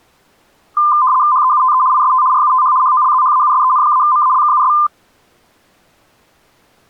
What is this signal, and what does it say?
RTTY (75 baud, 170 Hz shift), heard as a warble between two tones, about 1110 Hz centre. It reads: HEUTE IST RUTH HOLZHAUSEN-MALKUS